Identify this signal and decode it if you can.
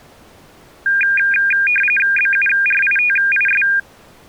RTTY (45.45 baud, 850 Hz shift), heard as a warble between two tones, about 2000 Hz centre. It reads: BURITIS